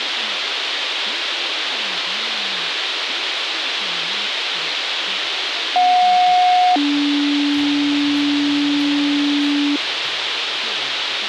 Two-tone page, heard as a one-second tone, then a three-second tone, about 730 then 290 Hz, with radio hiss.